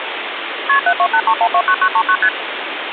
Multi-frequency trunk signalling (R1, as on North American trunks), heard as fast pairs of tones, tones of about 70 ms, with phone line noise. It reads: KP 7283129939 ST